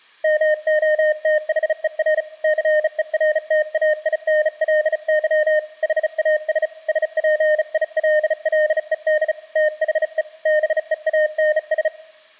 Morse code, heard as a keyed tone, hand-sent with a bug key, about 35 wpm, 610 Hz. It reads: MOTHER CERTAINLY HAS SPILLED THE BEANS